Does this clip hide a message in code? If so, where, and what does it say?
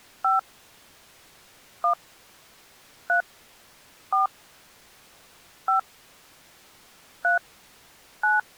Yes: DTMF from 0.2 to 8.4 s, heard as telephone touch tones, dialled by hand, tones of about 130 ms. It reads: 5 1 3 4 5 3 9